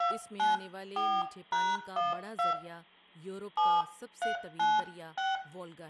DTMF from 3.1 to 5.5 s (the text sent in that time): 7396